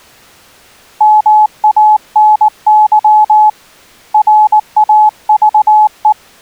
Morse code, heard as a keyed tone, hand-sent with a paddle, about 19 wpm, 850 Hz. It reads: MANY RAVE